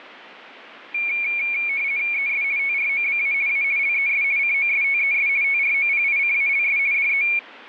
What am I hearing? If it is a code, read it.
RTTY (50 baud, 170 Hz shift), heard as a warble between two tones, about 2300 Hz centre. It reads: ES TROBA A LES COSTES TROPICALS DE